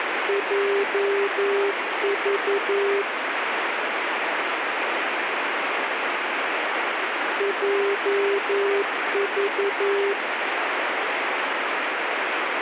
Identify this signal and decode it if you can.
Morse code, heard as a keyed tone, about 11 wpm, 400 Hz, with radio static. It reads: JV JV